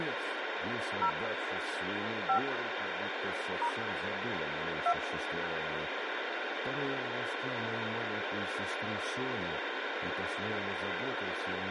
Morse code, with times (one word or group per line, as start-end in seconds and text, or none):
none